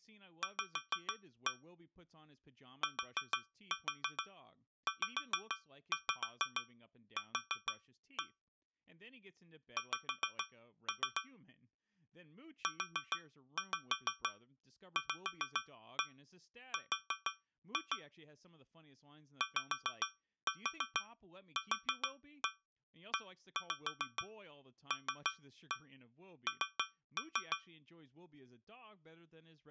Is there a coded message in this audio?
Yes: tap code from 0.4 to 27.7 s, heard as taps on a metal pipe, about 6 knocks a second, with speech in English. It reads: V TZQ X UVR YQELN